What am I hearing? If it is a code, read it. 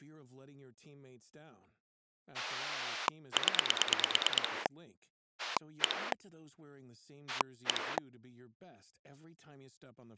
Pulse dialling, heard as a rotary dial, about 9 pulses a second, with speech in Italian. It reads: 0 1 1